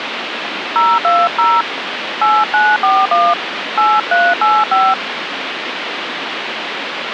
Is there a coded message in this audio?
Yes: DTMF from 0.8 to 4.9 s, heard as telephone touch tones, dialled by hand, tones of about 220 ms, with phone line noise. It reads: 020 8941 8385